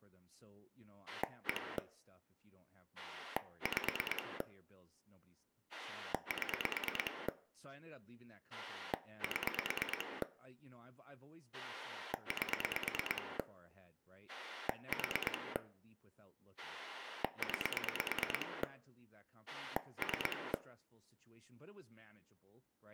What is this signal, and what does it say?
Pulse dialling, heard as a rotary dial, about 9 pulses a second, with room echo and speech in English. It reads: 1 5 7 7 8 4 9 3